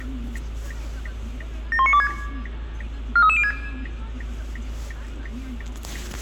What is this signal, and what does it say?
Five-tone selective call (ZVEI), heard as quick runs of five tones, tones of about 70 ms, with the noise inside a car. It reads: 71926 43306